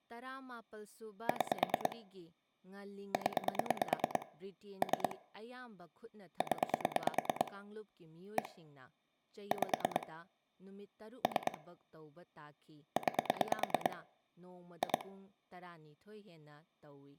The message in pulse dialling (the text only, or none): 6 0 3 0 1 5 3 9 2